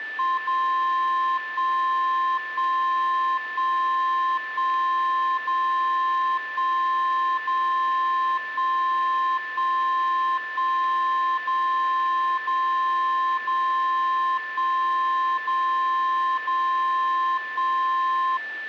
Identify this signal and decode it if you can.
Radio time signal (DCF77), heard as a tone whose level steps once a second, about 1050 Hz, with a steady whistle near 1760 Hz. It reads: 0 1 1 1 1 0 1 0 1 1 1 0 0 0 1 0 0 1